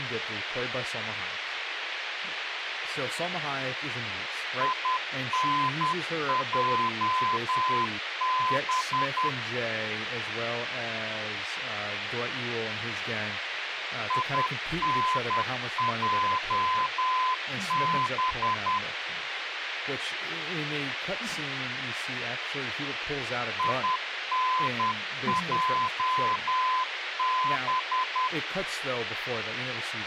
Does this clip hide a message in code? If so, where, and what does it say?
Yes: Morse code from 4.5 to 28.3 s, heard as a keyed tone, machine-sent, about 10 wpm, 1020 Hz, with radio hiss, a squelch burst at the end and speech in English. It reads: INJB INJB INJB